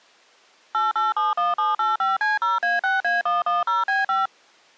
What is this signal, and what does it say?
DTMF, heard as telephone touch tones, dialled by machine, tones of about 170 ms. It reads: 8871785C0A6A110B5